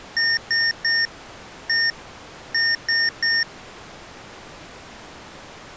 Beep code, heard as beeps from a small speaker, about 1850 Hz. 3-1-3. In Phoenix BIOS tables: interrupt mask register failure.